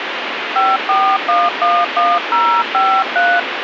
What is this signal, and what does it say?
DTMF, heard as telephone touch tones, dialled by hand, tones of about 260 ms, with radio hiss. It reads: 54111053